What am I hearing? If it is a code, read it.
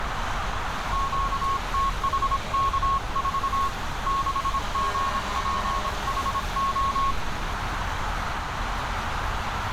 Morse code, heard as a keyed tone, hand-sent with a paddle, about 26 wpm, 1090 Hz, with radio static, a narrow filter and street noise. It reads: QTHK4 6GPHO